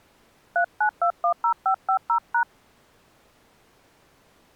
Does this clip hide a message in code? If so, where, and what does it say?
Yes: DTMF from 0.6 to 2.4 s, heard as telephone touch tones, dialled by hand, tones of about 90 ms. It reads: 39210550#